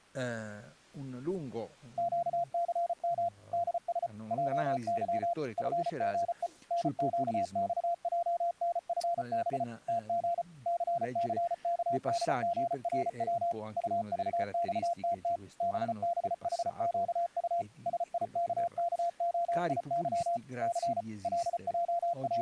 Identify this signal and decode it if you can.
Morse code, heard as a keyed tone, machine-sent, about 34 wpm, 690 Hz, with speech in Italian. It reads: QCM DS JY FGE NQXJNFB TG CCKDGRW UVXTT BBHQU SIKKOIY C …